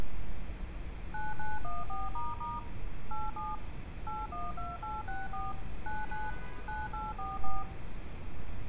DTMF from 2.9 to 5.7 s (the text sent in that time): 87 812864